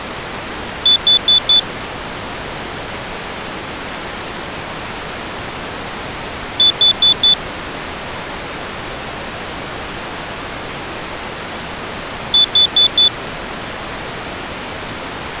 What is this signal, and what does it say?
Alarm pattern, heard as an alarm's beeps, played three times, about 3500 Hz. Temporal four. Carbon monoxide.